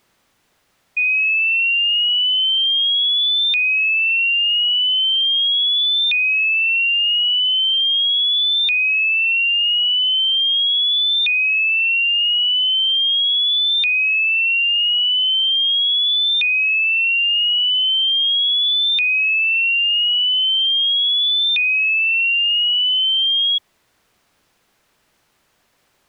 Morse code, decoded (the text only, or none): none